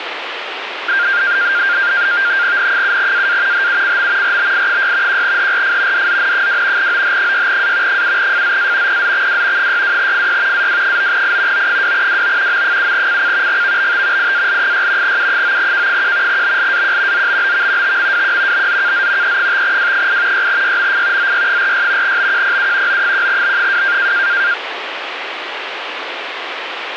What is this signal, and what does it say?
NAVTEX (SITOR-B), 100 baud, 170 Hz shift, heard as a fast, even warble, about 1500 Hz centre, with radio static. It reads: N7AA HUCM RBI6 1HRF DZN2 OH6A 7FZA PZXW 62FY AW9I O2WO M7CC GVBT IAL6 U9K1 BLAQ ZBBV TMWQ BZKZ E5W8 6YMF ZY46 BQPU O1B2